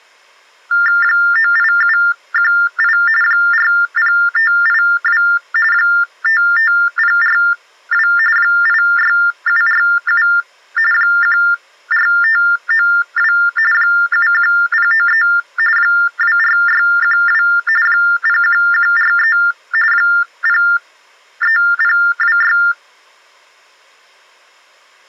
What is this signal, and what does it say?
TTY/TDD text telephone tones (45.45 baud Baudot), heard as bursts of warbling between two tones, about 400 Hz shift, 1600 Hz centre. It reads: 98718 40582 55042 86747 14592 71093 24612 01143 03026